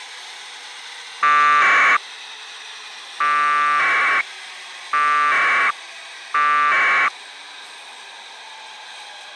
Packet radio (AX.25, as in APRS), 1200 baud, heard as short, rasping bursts, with the noise of a subway station.